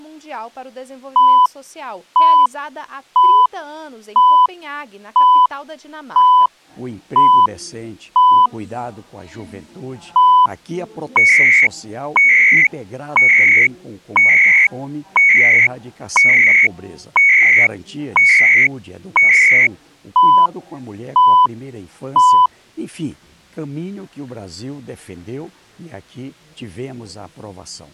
Radio time signal (CHU, Canada), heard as beeps and data bursts, one a second.